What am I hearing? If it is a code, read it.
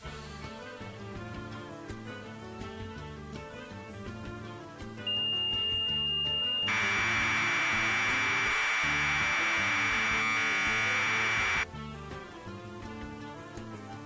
Commodore tape loading (standard loader), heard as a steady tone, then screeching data.